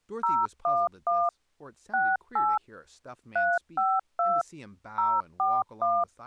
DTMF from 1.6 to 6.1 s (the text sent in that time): 68 352 041